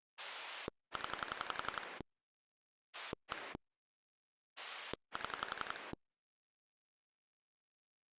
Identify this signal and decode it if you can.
Pulse dialling, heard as a rotary dial, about 11 pulses a second. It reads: 0 1 7